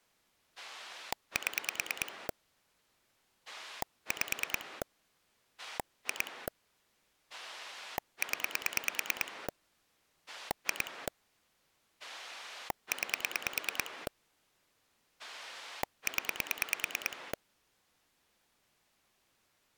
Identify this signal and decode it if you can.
Pulse dialling, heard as a rotary dial, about 9 pulses a second. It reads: 7 5 2 0 2 9 0